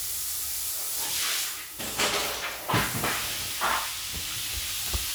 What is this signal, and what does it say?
The noise of a restroom. There is no code.